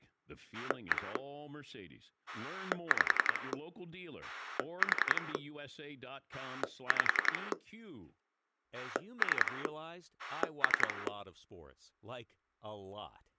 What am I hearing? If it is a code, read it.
Pulse dialling, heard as a rotary dial, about 10 pulses a second, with speech in English. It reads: 1 5 4 5 3 3